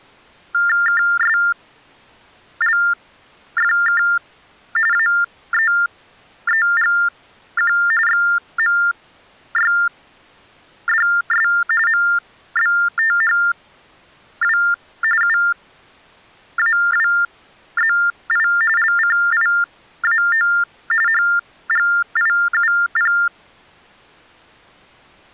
TTY/TDD text telephone tones (45.45 baud Baudot), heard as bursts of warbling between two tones, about 400 Hz shift, 1600 Hz centre. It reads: KSLFK AEEGQ XMYDS MBTHW UAWZI LCIAO HGIUP